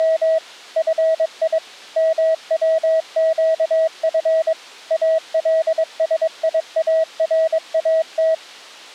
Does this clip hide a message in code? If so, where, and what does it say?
Yes: Morse code (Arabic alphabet) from 0.0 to 8.4 s, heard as a keyed tone, machine-sent, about 22 wpm, 640 Hz. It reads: … في موقف السيارات